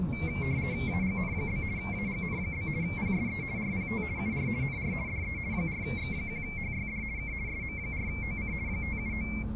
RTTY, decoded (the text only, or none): AGN? AGN? PSE RPT UR NR DE 4X1HYD K SM4OC 579